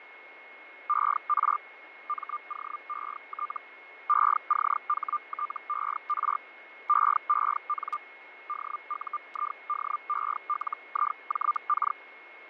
Hellschreiber (Feld-Hell, 122.5 baud), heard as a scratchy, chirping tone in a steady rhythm, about 1200 Hz, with radio static, fading and a steady whistle near 2170 Hz. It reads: ER MOET ECHTER EEN DUIDELIJK